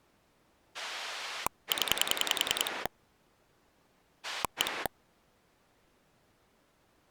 Pulse dialling, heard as a rotary dial, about 10 pulses a second. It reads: 0 1